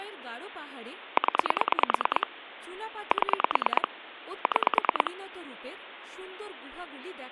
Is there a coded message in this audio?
Yes: pulse dialling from 1.2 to 5.1 s, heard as clicks on a phone line, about 9 pulses a second, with phone line noise and speech in Bangla. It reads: 0 7 6